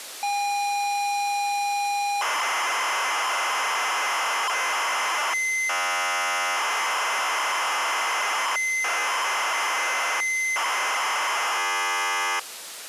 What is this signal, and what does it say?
ZX Spectrum tape loading, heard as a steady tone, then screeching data.